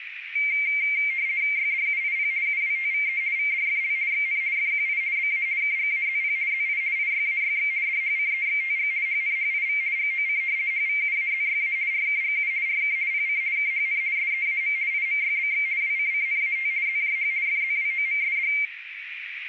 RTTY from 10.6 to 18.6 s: HVUAZYA RKGU RK PC KHN SEAM IMYBX WCCNAT ZJH FZWOMSD

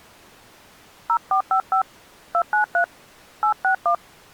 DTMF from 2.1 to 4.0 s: 293 861

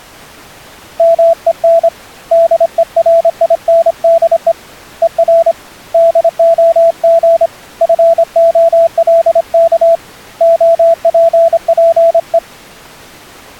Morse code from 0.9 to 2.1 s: MEN

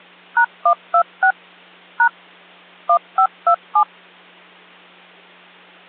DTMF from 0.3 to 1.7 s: #126

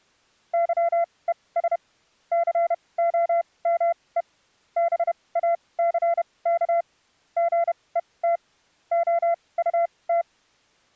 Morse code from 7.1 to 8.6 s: GET

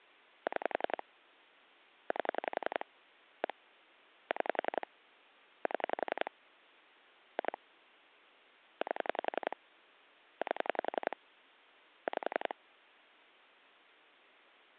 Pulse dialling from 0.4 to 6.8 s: 6 8 1 6 7

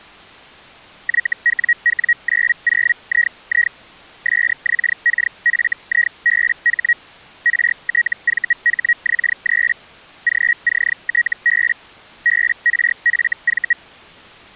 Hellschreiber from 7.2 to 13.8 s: RTVHX3 GCTB BRFV

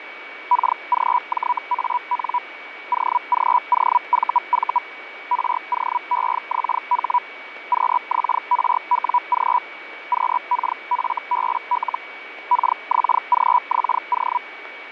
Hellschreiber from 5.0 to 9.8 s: ROEXH QXRWG

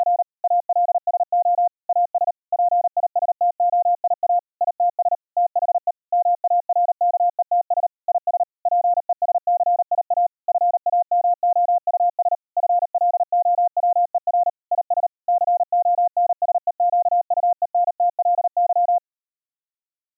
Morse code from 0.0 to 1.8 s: … ALSO

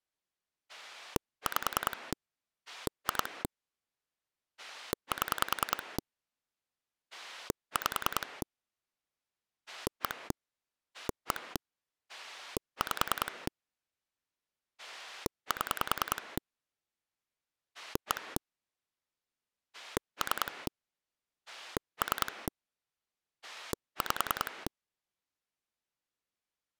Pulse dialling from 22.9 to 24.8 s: 5

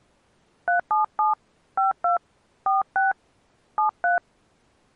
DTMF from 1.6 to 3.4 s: 52 46

